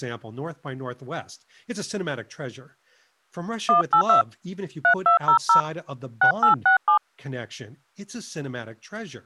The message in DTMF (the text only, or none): 182 3200 6867